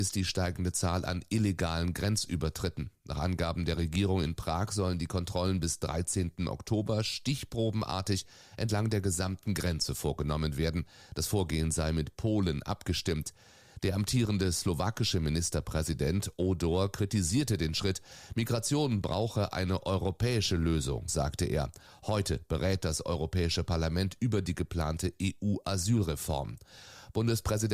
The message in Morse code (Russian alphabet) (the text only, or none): none